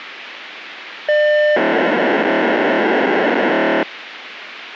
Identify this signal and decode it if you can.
POCSAG pager data (1200 baud), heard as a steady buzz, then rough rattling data, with radio hiss.